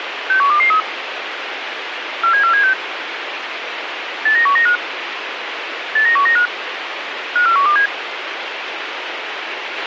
Five-tone selective call (CCIR), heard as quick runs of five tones, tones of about 100 ms, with radio hiss and a squelch burst at the end. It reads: 61223 47476 89195 89195 54127